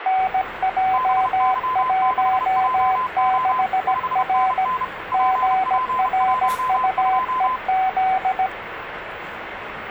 Morse code, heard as two keyed tones, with radio static and the noise of a cafe. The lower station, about 17 wpm, 760 Hz: NJ16R GRUEZ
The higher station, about 31 wpm, 1020 Hz: BY6JO 5NN PP12